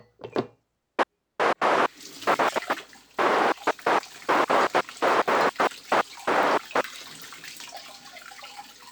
Bursts of noise, with kitchen noise. There is no code.